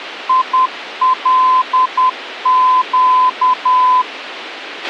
Morse code, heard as a keyed tone, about 10 wpm, 1020 Hz, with a squelch burst at the end. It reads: ILQ